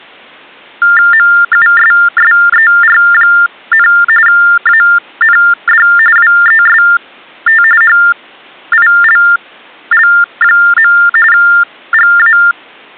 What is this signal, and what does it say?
TTY/TDD text telephone tones (45.45 baud Baudot), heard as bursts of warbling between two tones, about 400 Hz shift, 1600 Hz centre. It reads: MUSSER, AND WEST HILL. GA